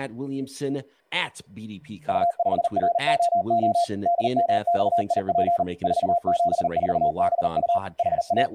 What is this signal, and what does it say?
Morse code, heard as a keyed tone, machine-sent, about 39 wpm, 690 Hz, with speech in English. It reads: U5ROO DMXIP 474BU …